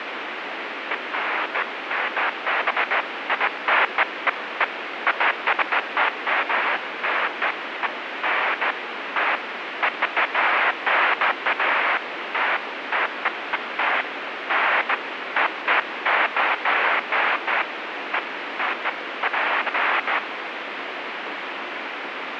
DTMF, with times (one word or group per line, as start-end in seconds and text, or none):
none